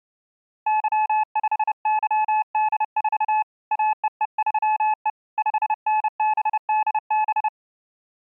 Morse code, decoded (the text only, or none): Y5YD4 AEE3E 5NBDB